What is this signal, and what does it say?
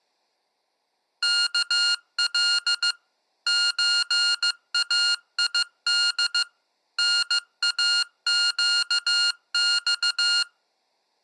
Morse code (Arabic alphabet), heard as electronic beeps, machine-sent, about 15 wpm, 1420 Hz. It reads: كل زايد ناقص